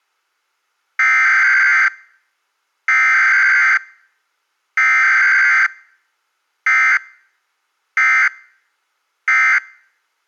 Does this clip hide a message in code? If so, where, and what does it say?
Yes: Emergency Alert System (SAME) tones (header bursts, then end-of-message bursts) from 1.0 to 9.6 s, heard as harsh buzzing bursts, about 520.83 baud.